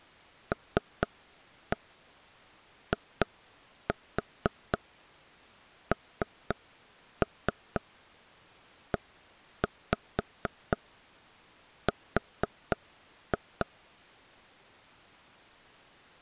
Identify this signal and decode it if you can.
Tap code, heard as taps on a table, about 4 knocks a second. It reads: LINER